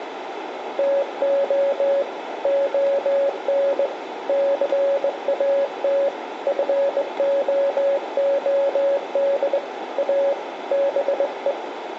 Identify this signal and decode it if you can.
Morse code, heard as a keyed tone, hand-sent with a straight key, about 20 wpm, 560 Hz, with radio static, a narrow filter and room echo. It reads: TO ON CAT FOOD A BE